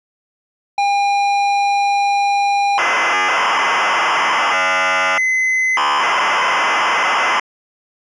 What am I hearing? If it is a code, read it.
ZX Spectrum tape loading, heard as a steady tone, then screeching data.